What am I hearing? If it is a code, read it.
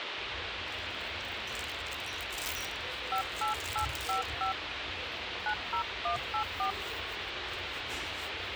DTMF, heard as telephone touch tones, dialled by hand, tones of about 100 ms, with radio hiss and the noise of a restaurant. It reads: 58855 90184